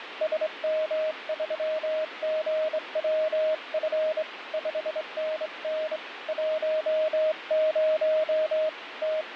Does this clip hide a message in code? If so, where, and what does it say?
Yes: Morse code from 0.2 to 9.4 s, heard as a keyed tone, hand-sent with a straight key, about 24 wpm, 620 Hz, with radio static. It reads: SM3GWF 5NN 10 …